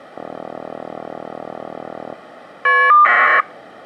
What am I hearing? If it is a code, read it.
Caller ID data burst, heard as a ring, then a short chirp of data, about 1200 baud.